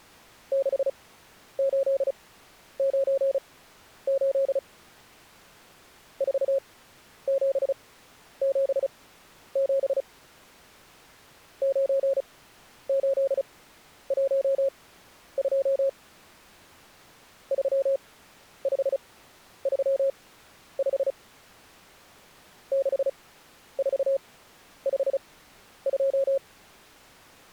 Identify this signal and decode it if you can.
Morse code, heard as a keyed tone, machine-sent, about 35 wpm, spaced as for 11 wpm, 540 Hz. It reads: 6898 4777 9812 3535 6452